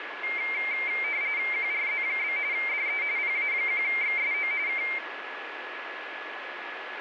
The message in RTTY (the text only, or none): QRZ? DE PA1XSO K